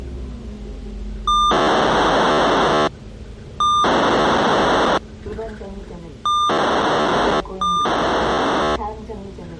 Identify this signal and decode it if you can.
POCSAG pager data (2400 baud), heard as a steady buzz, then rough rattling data, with the noise inside a bus.